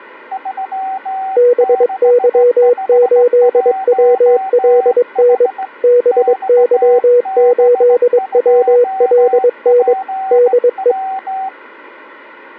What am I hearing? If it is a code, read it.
Morse code, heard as two keyed tones. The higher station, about 17 wpm, 770 Hz: 3651H XB2PW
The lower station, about 22 wpm, 490 Hz: BY8WLN BY8WLN DE